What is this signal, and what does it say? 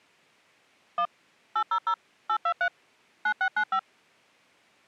DTMF, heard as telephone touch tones, dialled by machine, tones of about 80 ms. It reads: 1 800 823 9695